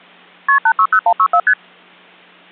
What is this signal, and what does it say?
Multi-frequency trunk signalling (R1, as on North American trunks), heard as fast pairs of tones, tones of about 70 ms. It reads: KP 860164 ST